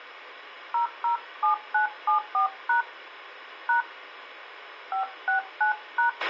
DTMF, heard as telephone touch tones, dialled by hand, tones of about 120 ms, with a squelch burst at the end. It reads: 007974# # 569#